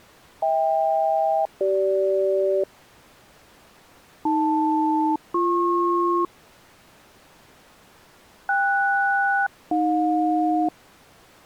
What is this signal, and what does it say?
Aircraft SELCAL, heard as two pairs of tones. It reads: HK-CG AL-BP KS-AJ